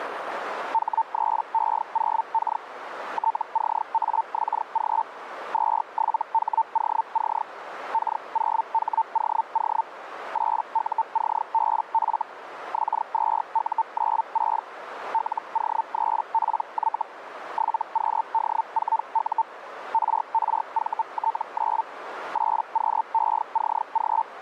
Hellschreiber (Feld-Hell, 122.5 baud), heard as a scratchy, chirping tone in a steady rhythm, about 900 Hz, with radio static and a narrow filter. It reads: H3E0K TCAXG 27HOC K0HOO 8UCBF X2U96 LO3PY 7QD4U RRVT9 8QECG